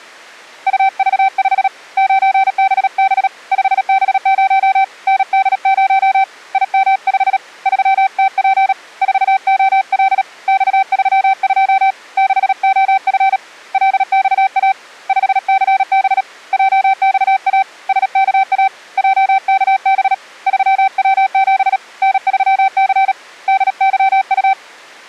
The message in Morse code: UV5 9BB 5B0 ND0 IM5 3TP 4OL X32 6OF LXA 5CB JXA SKA JKB 3W7 N3C DYU

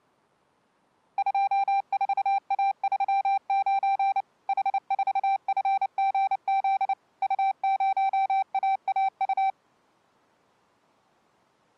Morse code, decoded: 24A39 H4FGZ U0AAU

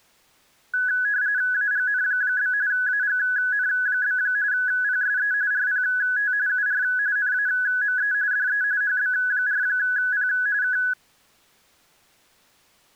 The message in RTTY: AGN? AGN? PSE RPT UR NAME DE HB4P K

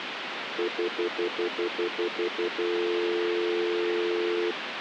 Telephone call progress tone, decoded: stutter dial tone

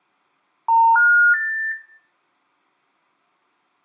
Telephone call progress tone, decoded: special information tone

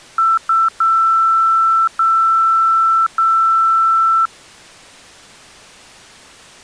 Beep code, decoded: 2 short, 3 long

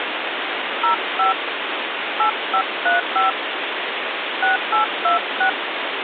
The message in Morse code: none

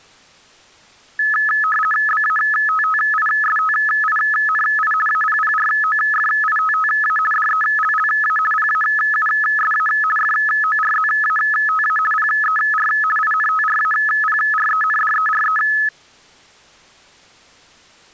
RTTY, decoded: BATTISTINI APPROFITTA DELLA PAUSA FORZATA PER INTRAPRENDERE

